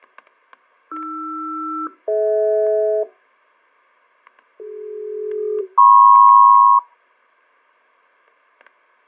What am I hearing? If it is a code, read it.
Aircraft SELCAL, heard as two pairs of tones, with fading and static crashes. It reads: AR-DH CD-MP